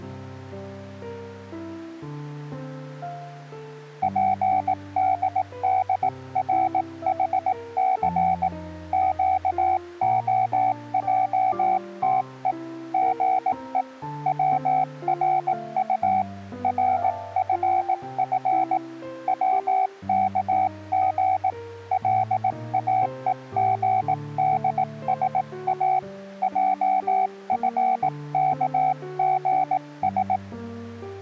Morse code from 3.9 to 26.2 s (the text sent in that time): PDDRHC QOJTE GE WRU RFF WKG LAEGDSA